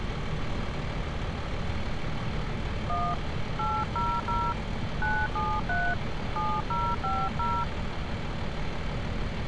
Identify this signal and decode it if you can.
DTMF, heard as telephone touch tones, dialled by hand, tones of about 240 ms, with phone line noise and street noise. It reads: 1 800 973 7050